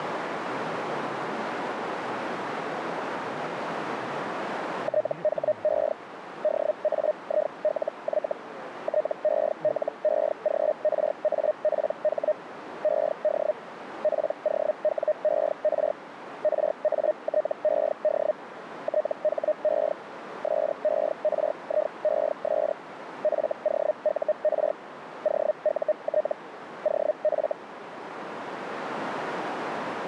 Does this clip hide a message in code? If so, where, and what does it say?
Yes: Hellschreiber (Feld-Hell, 122.5 baud) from 4.8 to 27.5 s, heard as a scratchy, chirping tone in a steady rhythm, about 610 Hz, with radio static and a narrow filter. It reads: THE DAILY TELEGRAPH ED POWER RATED THE SERIES FOUR OUT OF